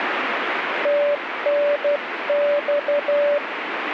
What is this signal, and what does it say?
Morse code, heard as a keyed tone, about 12 wpm, 580 Hz, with radio static. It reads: TNX